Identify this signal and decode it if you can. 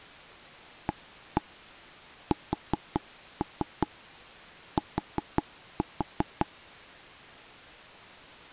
Tap code, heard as taps on a table, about 5 knocks a second. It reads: AST